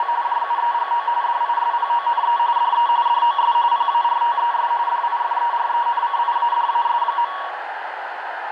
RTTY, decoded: … JUEGO DISPONE DE DOS PARTES DIFERENCIADAS.

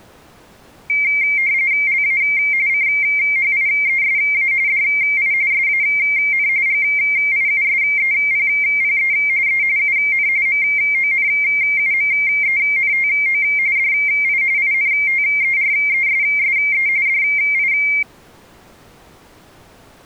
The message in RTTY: LA CHIESA DI SAN GIUSEPPE E UN MONUMENTO DI INTERESSE DI

